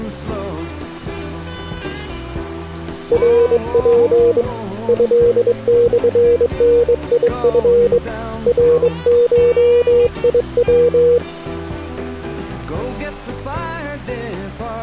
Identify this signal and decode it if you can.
Morse code (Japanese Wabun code), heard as a keyed tone, hand-sent with a straight key, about 22 wpm, 480 Hz. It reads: ナツ トモダチ ナゴヤ